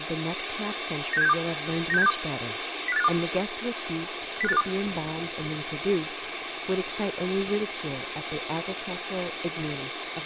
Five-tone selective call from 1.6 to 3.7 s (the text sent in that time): 96762 05852